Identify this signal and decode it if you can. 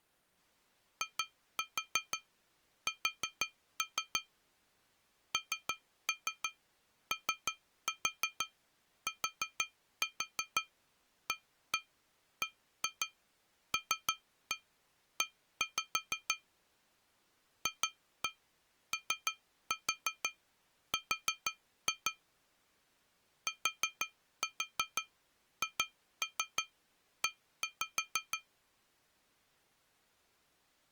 Tap code, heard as taps on glass, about 6 knocks a second. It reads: IS NOTABLE FOR THE